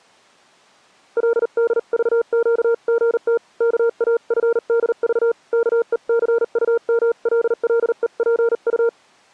Morse code (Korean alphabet), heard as a keyed tone, hand-sent with a paddle, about 39 wpm, 460 Hz. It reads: 그래서 오늘 아침까지